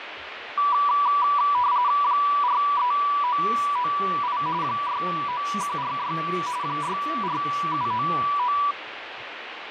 RTTY (45.45 baud, 170 Hz shift), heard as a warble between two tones, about 1070 Hz centre, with radio static, fading and speech in Russian. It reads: 43998 69146 64799